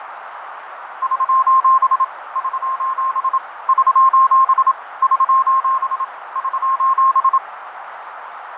Morse code, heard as a keyed tone, machine-sent, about 27 wpm, 1060 Hz, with radio static, fading and a narrow filter. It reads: <SOS> <SOS> <SOS> <SOS> <SOS>